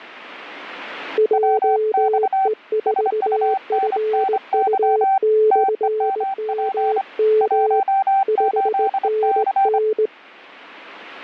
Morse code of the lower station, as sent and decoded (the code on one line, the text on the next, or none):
.--- . ....- ..-. ..- -..-. -- -- / ..... -. -.
JE4FU/MM 5NN